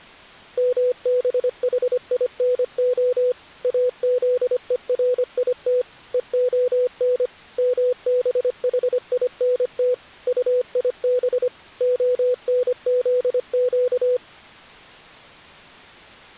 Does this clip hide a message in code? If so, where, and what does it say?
Yes: Morse code (Hebrew alphabet) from 0.5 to 14.2 s, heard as a keyed tone, machine-sent, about 25 wpm, 500 Hz. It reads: מבחינה אזורית והן מבחינת טיב הנזק